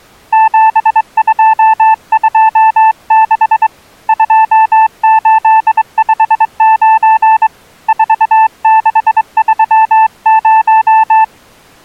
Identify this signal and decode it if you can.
Morse code, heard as a keyed tone, hand-sent with a straight key, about 23 wpm, 880 Hz. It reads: 7226 2859 4630